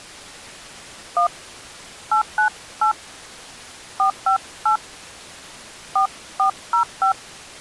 DTMF, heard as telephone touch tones, dialled by hand, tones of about 100 ms. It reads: 1 898 458 4405